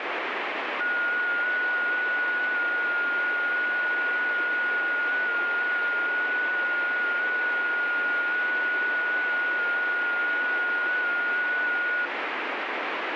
FT8 (one signal), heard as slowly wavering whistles, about 6.25 baud, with radio static.